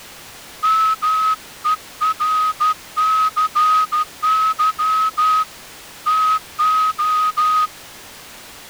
Morse code, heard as a whistle, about 13 wpm. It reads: MERCY TO